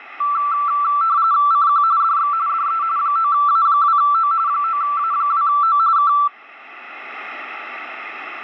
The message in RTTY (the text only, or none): CQ DX DE 9A2O 9A2O K